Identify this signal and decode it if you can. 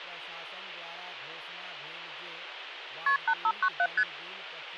Multi-frequency trunk signalling (R1, as on North American trunks), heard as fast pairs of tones, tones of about 60 ms, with phone line noise and speech in Maithili. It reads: KP 8597 ST